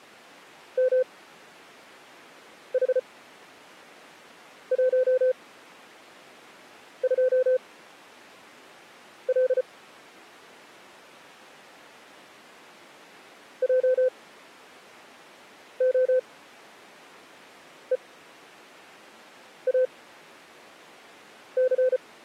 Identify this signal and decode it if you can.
Morse code, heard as a keyed tone, machine-sent, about 34 wpm, spaced as for 5 wpm, 510 Hz. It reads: MH12L JOEAC